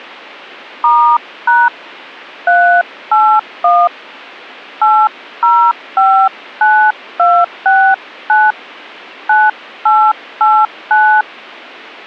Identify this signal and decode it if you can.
DTMF, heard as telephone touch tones, dialled by hand, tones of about 290 ms. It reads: *# 381 8059269 9889